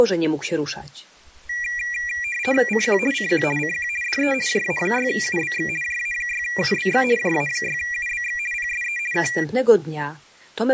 RTTY (50 baud, 450 Hz shift), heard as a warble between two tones, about 2150 Hz centre. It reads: CQ CQ CQ DE JA6UBX JA6UBX JA6UBX PSE K